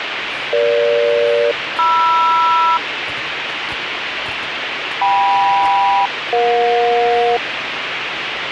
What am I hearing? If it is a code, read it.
Aircraft SELCAL, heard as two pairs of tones, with radio hiss and the noise of a restaurant. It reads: EG-MR KM-EJ